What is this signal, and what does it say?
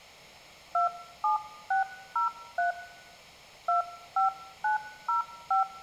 DTMF, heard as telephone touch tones, dialled by hand, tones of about 130 ms. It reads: 27603 25905